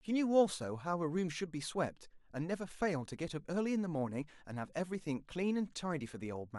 Speech in English. There is no code.